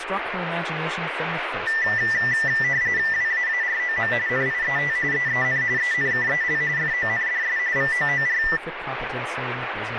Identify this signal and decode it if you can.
RTTY (45.45 baud, 170 Hz shift), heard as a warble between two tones, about 1900 Hz centre, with radio static and speech in English. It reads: WAAROM NIET EEN ENKEL FONDS VOOR